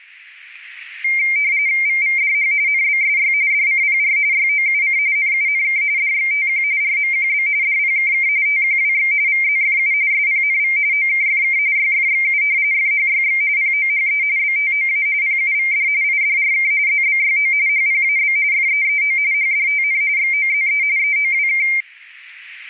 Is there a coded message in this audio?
Yes: RTTY (45.45 baud, 170 Hz shift) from 1.0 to 21.8 s, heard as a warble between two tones, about 2200 Hz centre. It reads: VVDH NBSY DCPR YOUC NUNK DXTQ RMQB DPKK TQWX VZFU SPNV OKFK YFXU FHYX POHE BTOA PUVD IDRK ZBYO HPAB FEEO HDTN XOZE EOWK